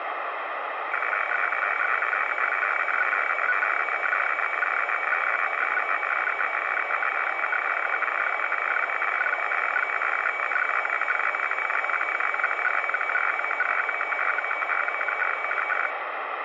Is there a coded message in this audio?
Yes: weather fax (radiofax), 120 lines a minute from 0.9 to 15.9 s, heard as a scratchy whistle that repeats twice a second, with radio static.